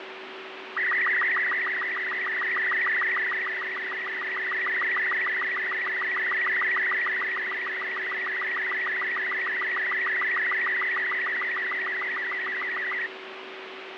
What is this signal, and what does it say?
SSTV (slow-scan television), Robot 36, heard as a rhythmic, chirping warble, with radio static, fading and a steady whistle near 380 Hz.